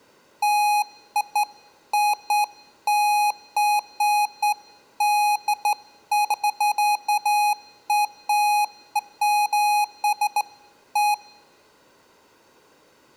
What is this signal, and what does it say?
Beeps of irregular length, with room echo. There is no code.